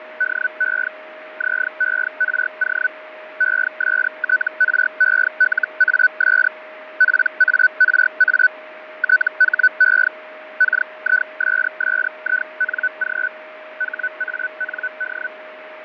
Hellschreiber (Feld-Hell, 122.5 baud), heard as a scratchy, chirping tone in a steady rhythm, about 1500 Hz, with radio static, fading and a steady whistle near 620 Hz. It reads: DE ZERO ESTRELAS PARA THE KISSING HAND